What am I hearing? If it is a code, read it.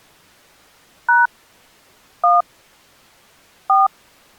DTMF, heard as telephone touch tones, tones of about 170 ms. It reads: # 1 4